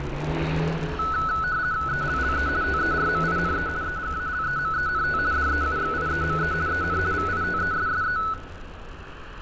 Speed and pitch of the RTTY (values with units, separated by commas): 50 baud, 170 Hz shift, 1390 Hz centre